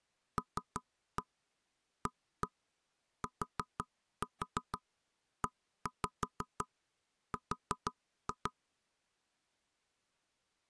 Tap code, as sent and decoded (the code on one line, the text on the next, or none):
3-1 1-1 4-4 1-5 4-2
LATER